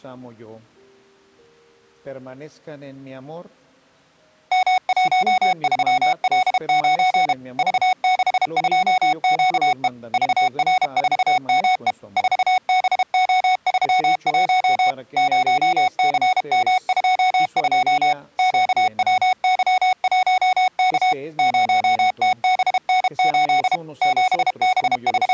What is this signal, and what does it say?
Morse code, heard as electronic beeps, machine-sent, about 32 wpm, 740 Hz. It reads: M13L9 V62QE VR4ME 4BO31 0CM22 QWY1K 0TBN8 …